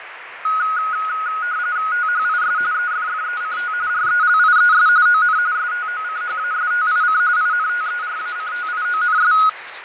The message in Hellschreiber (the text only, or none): none